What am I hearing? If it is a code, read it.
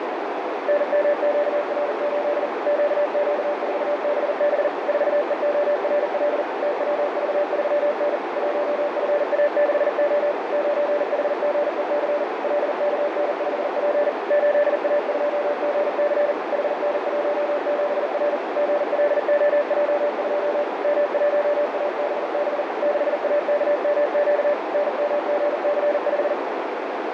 Morse code, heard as a keyed tone, machine-sent, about 40 wpm, 590 Hz, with heavy radio static and a narrow filter. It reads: NMQR8 QQ4BB 4EORL TWV3N 1FA6O 9HGEC LKN5P 8A2GC HN17R GLOJ2 M1ABB 6AKMQ NMGC5